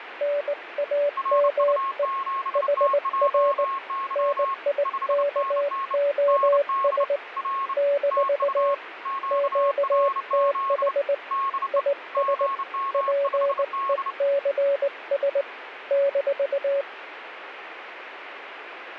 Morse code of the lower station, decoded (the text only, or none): NAME HR NIKOS - QTH IS PECS -